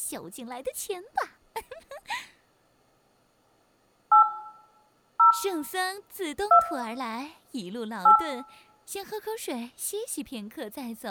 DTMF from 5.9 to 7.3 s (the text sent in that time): 2